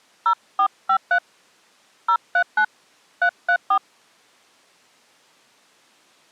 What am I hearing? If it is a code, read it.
DTMF, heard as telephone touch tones, dialled by hand, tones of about 80 ms. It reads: 0453 039 334